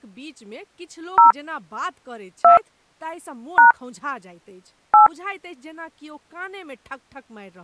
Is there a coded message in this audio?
Yes: DTMF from 1.2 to 5.1 s, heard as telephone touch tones, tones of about 130 ms, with speech in Maithili. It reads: 0 2 # 8